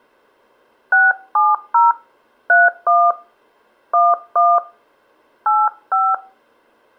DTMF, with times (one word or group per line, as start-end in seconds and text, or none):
0.9-1.9 670
2.5-3.1 31
3.9-4.6 11
5.5-6.1 85